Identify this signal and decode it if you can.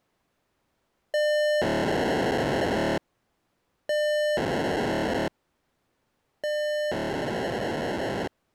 POCSAG pager data (1200 baud), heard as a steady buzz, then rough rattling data.